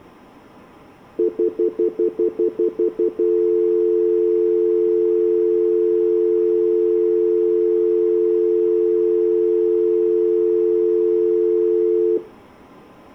Telephone call progress tone (North American plan), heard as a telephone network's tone, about 350, 440 Hz, 0.1 s on and 0.1 s off, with room echo. Stutter dial tone.